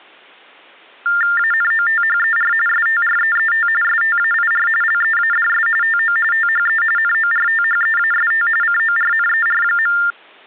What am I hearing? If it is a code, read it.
TTY/TDD text telephone tones (45.45 baud Baudot), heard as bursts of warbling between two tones, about 400 Hz shift, 1600 Hz centre. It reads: ANOTHER STREET STAIR LEADS TO THE NORTHEAST CORNER.